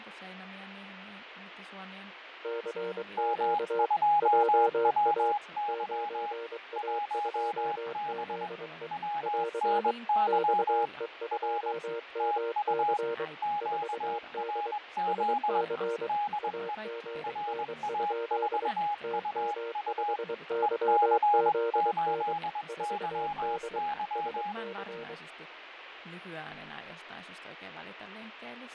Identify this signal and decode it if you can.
Morse code, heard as two keyed tones, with radio static, fading and speech in Finnish. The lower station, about 23 wpm, 460 Hz: CQ JA 9A2ZE <AR> XE2MC 4D SC AGN? TM5YZN 4D SC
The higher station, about 21 wpm, 830 Hz: M2WY 1B WNY R TU QRZ DE RA4UU EC8YY